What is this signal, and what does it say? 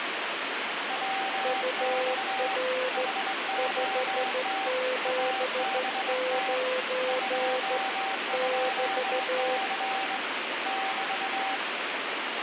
Morse code, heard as two keyed tones, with heavy radio static. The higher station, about 21 wpm, 770 Hz: WX HOT ABT 22C <BT>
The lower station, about 14 wpm, 510 Hz: UR 579 <BT>